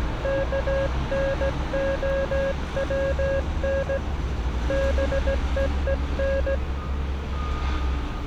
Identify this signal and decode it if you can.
Morse code, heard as a keyed tone, hand-sent with a straight key, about 16 wpm, 540 Hz, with street noise. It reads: KNOWN BEEN